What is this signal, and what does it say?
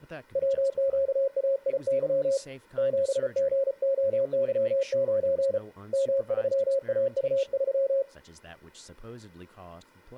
Morse code, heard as a keyed tone, hand-sent with a paddle, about 34 wpm, 540 Hz, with speech in English. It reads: WQAIY 7GOY9 M3AU3